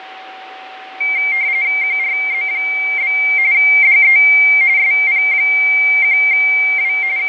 RTTY (45.45 baud, 170 Hz shift), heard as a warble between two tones, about 2200 Hz centre, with fading and a steady whistle near 760 Hz. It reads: QRZ? DE SP1W …